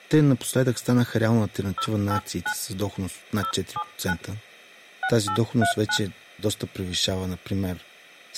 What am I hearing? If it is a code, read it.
DTMF, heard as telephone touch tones, dialled by hand, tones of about 80 ms, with speech in Bulgarian. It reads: 089 079 6839